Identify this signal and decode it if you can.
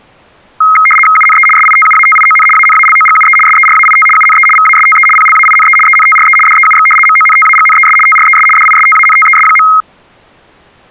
RTTY (75 baud, 850 Hz shift), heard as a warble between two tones, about 1700 Hz centre. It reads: UNE SITUATION ANALOGUE SERAIT UNE VASTE PLAINE ENTRE DEUX MONTAGNES TRES DISTANTES.